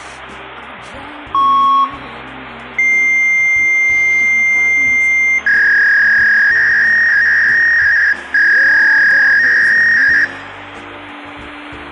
Fax machine handshake, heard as a beep, a long tone and a warble, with phone line noise and room echo.